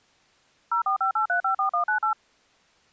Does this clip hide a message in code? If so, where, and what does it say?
Yes: DTMF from 0.7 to 2.1 s, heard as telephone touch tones, dialled by machine, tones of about 110 ms. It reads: 0458354198